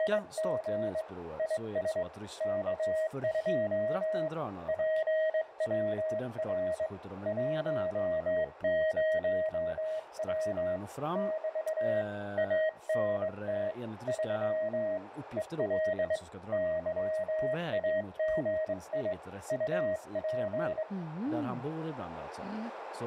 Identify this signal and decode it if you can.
Morse code, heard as a keyed tone, hand-sent with a straight key, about 22 wpm, 630 Hz, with radio static, a narrow filter and speech in Swedish. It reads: … IS K2 PWR 10W <BT> ANT 3 EL YAGI UP